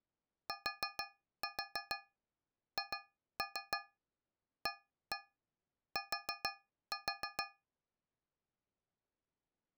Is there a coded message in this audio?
Yes: tap code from 0.5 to 7.6 s, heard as taps on a metal pipe, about 6 knocks a second. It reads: THAT